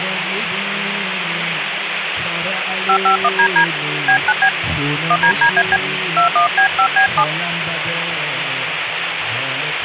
DTMF, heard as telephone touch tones, dialled by hand, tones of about 80 ms, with phone line noise. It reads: 551DD B9B 1DDAB 21B5B7